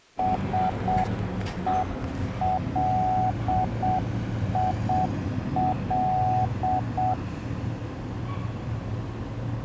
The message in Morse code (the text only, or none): SELIL